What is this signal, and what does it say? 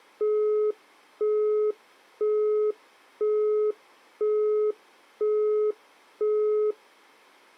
Telephone call progress tone (single-tone plan, as in Europe, Japan and elsewhere), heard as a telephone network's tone, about 420 Hz, 0.5 s on and 0.5 s off. Busy tone.